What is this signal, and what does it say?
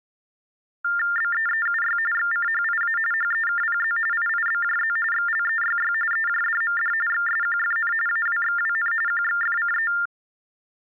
TTY/TDD text telephone tones (45.45 baud Baudot), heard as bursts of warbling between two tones, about 400 Hz shift, 1600 Hz centre. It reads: BEEUY XCHIA HEKPZ IIBJZ XLEYY EJDMD XSQFN AWXWN QXFCE